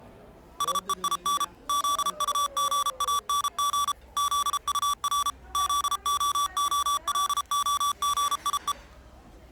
Morse code, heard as electronic beeps, machine-sent, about 33 wpm, 1150 Hz, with the noise of a restaurant. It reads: SEIN ZUGANG ZUR ZOOLOGIE